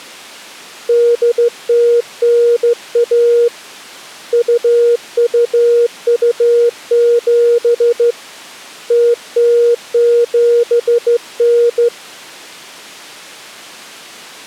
Morse code (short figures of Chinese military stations), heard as a keyed tone, hand-sent with a straight key, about 14 wpm, 470 Hz. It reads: 8091 2227 0079